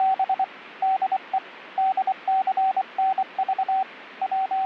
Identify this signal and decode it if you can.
Morse code, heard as a keyed tone, hand-sent with a paddle, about 24 wpm, 760 Hz, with radio static. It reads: … DE DCNV …